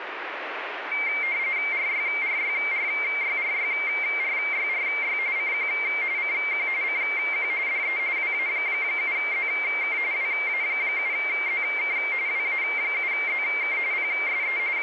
RTTY (45.45 baud, 170 Hz shift), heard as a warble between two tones, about 2200 Hz centre, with radio static. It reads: RYRYRYRYRYRY CQ CQ CQ DE WA7ZK WA7ZK WA7ZK PSE …